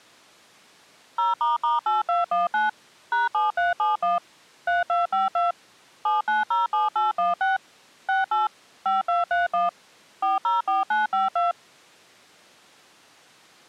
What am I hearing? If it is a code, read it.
DTMF, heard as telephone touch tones, dialled by machine, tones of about 160 ms. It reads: 0**8219 #7371 3252 7907816 68 5231 404952